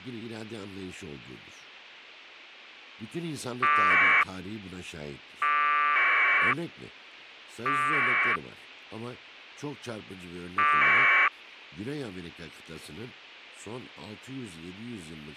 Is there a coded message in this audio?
Yes: packet radio (AX.25, as in APRS), 1200 baud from 3.6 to 11.3 s, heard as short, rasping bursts, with a squelch burst at the end and speech in Turkish.